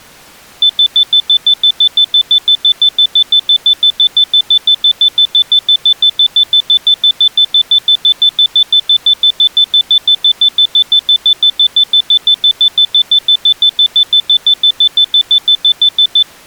Evenly repeated beeps. There is no code.